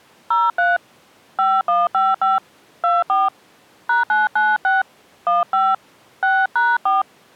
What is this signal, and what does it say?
DTMF, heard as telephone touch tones, dialled by hand, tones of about 190 ms. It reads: 03 5155 24 #996 15 6#4